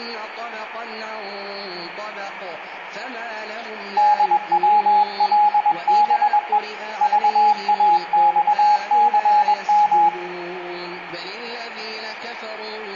Morse code, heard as a keyed tone, hand-sent with a paddle, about 21 wpm, 840 Hz, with radio static and room echo. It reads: DWLBE VAXCM